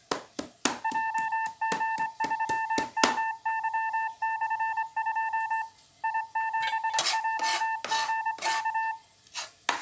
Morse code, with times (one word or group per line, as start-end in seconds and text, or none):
0.8-5.6 JG3MY/2
6.0-8.9 I7JGK